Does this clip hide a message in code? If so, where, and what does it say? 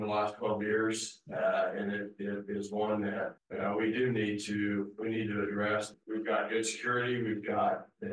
No.